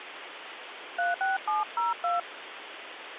DTMF, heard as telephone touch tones, dialled by hand, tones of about 160 ms, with phone line noise. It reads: 36702